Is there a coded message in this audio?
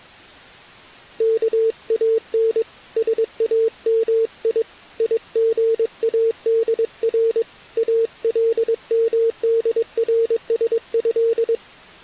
Yes: Morse code (Arabic alphabet) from 1.1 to 11.6 s, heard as a keyed tone, hand-sent with a paddle, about 22 wpm, 450 Hz. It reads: كان سامي يغادر المدرسه